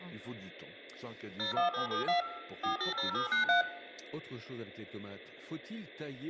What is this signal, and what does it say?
DTMF, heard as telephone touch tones, dialled by machine, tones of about 130 ms, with room echo and speech in French. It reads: 01772 480793